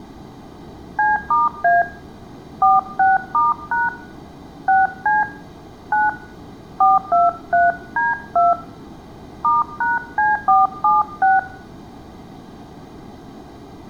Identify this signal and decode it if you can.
DTMF, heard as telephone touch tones, dialled by hand, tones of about 180 ms, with room echo. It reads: C*A 46*# 6C 9 423D2 *#C476